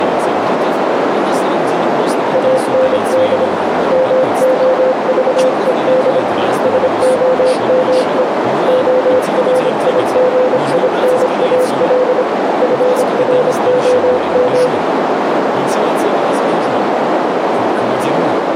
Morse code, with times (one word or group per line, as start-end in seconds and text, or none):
2.3-3.5 AND
3.9-6.2 MOVED
6.6-8.2 SOME
8.7-12.2 ORIGINAL
12.6-14.7 FROM